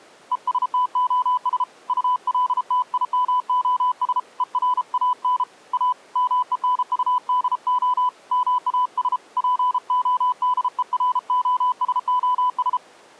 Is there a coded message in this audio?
Yes: Morse code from 0.3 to 12.8 s, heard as a keyed tone, hand-sent with a paddle, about 33 wpm, 1000 Hz. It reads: ESTOS ULTIMOS ERAN A MENUDO MAS PODEROSOS